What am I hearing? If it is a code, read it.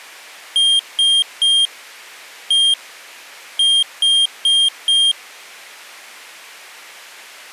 Beep code, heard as a piezo beeper, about 3200 Hz. 3-1-4. In Phoenix BIOS tables: interrupt mask register failure.